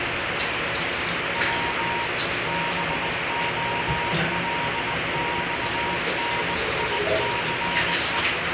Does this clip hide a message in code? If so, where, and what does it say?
Yes: Morse code (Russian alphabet) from 1.3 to 8.3 s, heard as a keyed tone, hand-sent with a bug key, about 19 wpm, 950 Hz, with heavy radio static and the noise of a restroom. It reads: В БОЛЬНИЦЕ